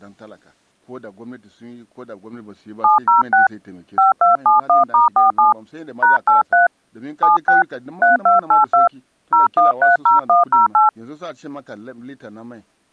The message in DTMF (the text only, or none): 706 5271*47 #83 76 3282 0130108